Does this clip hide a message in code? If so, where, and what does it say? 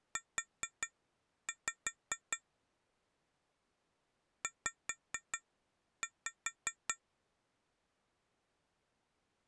Yes: tap code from 0.2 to 7.0 s, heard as taps on glass, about 5 knocks a second. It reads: U Z